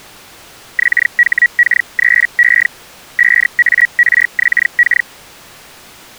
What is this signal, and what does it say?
Hellschreiber (Feld-Hell, 122.5 baud), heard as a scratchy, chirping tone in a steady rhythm, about 1900 Hz. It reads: XHK3E 5ARXK